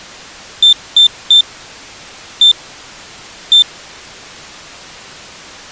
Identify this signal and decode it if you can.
Beep code, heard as a piezo beeper, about 3550 Hz. 3-1-1. In Phoenix BIOS tables: DMA register failure.